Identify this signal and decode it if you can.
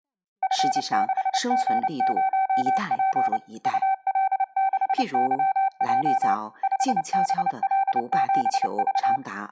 Morse code, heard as a keyed tone, machine-sent, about 29 wpm, 770 Hz, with speech in Chinese. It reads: F6G0P UL6YJ 5BL7V